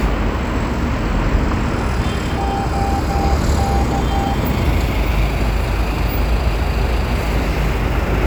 Morse code, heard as a keyed tone, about 13 wpm, 790 Hz, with street noise. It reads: OK